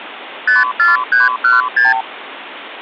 Multi-frequency trunk signalling (R2, with the far end's replies), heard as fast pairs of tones, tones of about 160 ms, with phone line noise. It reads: 54316